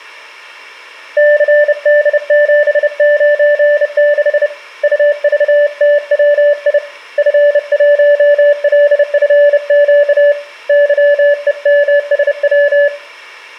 Morse code, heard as a keyed tone, hand-sent with a bug key, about 30 wpm, 580 Hz, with room echo. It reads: CD796 UVTWI F1LFQ YEMSW